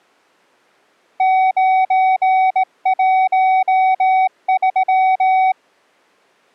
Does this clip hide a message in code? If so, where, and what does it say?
Yes: Morse code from 1.1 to 5.6 s, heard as a keyed tone, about 18 wpm, 750 Hz. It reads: 913